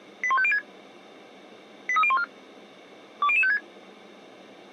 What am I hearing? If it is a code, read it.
Five-tone selective call (ZVEI), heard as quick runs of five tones, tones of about 70 ms. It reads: 81506 83014 20056